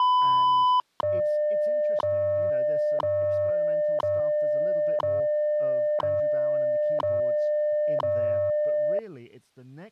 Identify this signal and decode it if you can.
Radio time signal (WWV, Colorado), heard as ticks, one a second, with speech in English.